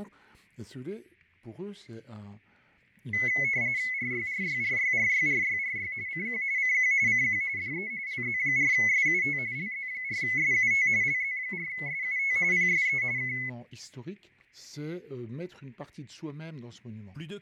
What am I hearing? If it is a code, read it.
RTTY (45.45 baud, 170 Hz shift), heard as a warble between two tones, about 2100 Hz centre, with fading and static crashes. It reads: RYRYRYRYRYRY CQ CQ CQ DE LZ4SUT LZ4SUT LZ4SUT PSE K